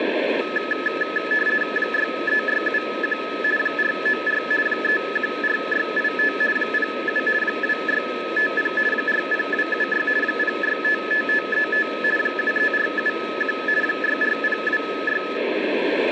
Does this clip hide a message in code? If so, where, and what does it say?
Yes: RTTY (50 baud, 450 Hz shift) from 0.4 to 15.4 s, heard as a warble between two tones, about 1500 Hz centre, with radio static. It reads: 63671 494 314685 07 2650 40276 0655535 73471 64026